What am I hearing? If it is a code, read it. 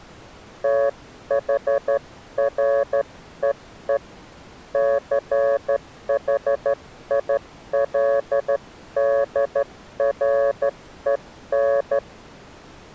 Morse code, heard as a keyed tone, hand-sent with a straight key, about 12 wpm, 560 Hz. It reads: THREE CHILDREN